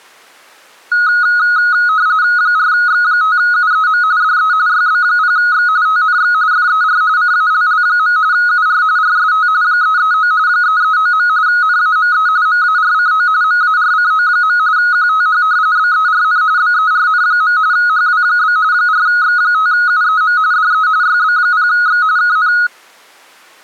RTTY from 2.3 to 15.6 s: 4X5UEM DE YB0X TNX FER CALL. UR RST 339 339. NAME MARCO MARCO. QTH

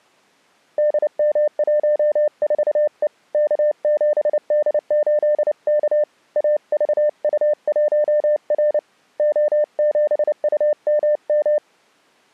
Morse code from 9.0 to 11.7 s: O7UMM

